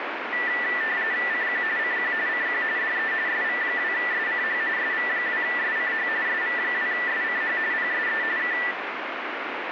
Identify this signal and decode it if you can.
RTTY (45.45 baud, 170 Hz shift), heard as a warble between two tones, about 1850 Hz centre, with radio static. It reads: CQ CQ CQ DE SV2SCH SV2SCH SV2SCH PSE K